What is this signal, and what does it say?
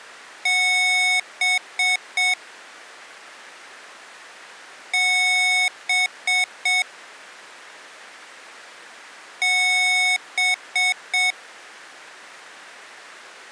Beep code, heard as beeps from a small speaker, played three times, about 740 Hz. 1 long, 3 short. In Award and IBM BIOS tables: video adapter failure; in AMI BIOS tables: memory failure.